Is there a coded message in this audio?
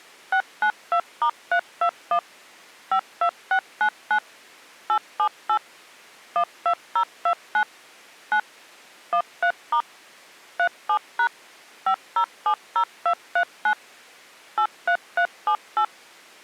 Yes: DTMF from 0.3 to 15.8 s, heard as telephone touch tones, dialled by machine, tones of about 80 ms. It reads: 692*321 52699 878 12029 9 13* 37# 5070239 83378